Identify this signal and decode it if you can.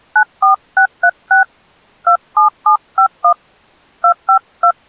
DTMF, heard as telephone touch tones, dialled by hand, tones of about 100 ms. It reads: 94636 27751 252